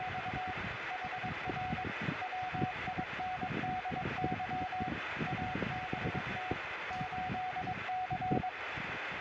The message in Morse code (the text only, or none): … HR WINDY ABT 8C